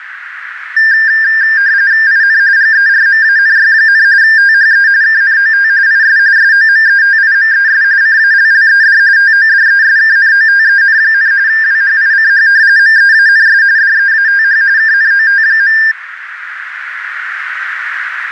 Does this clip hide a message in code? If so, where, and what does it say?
Yes: RTTY (45.45 baud, 170 Hz shift) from 0.8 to 15.9 s, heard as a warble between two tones, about 1700 Hz centre, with radio static and a narrow filter. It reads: IN GERMANY, THE KNOT IS SOMETIMES CALLED TODESKNOTEN, WHICH MEANS DEATH KNOT.